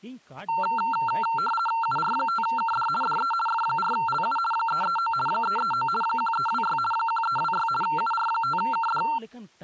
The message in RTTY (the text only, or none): UR5KD DE F4LU 339 339 1326 1326 UR5KD